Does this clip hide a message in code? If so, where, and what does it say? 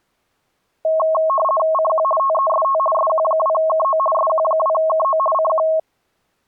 Yes: RTTY (50 baud, 450 Hz shift) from 0.8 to 5.8 s, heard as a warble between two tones, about 860 Hz centre. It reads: CQ TEST SQ2KO SQ2KO CQ